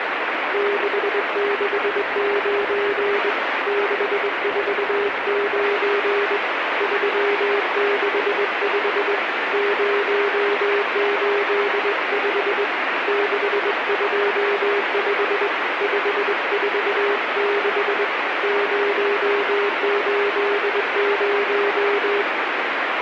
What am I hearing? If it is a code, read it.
Morse code, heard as a keyed tone, hand-sent with a straight key, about 21 wpm, 410 Hz, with heavy radio static. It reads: 669 649 365 085 625 546 080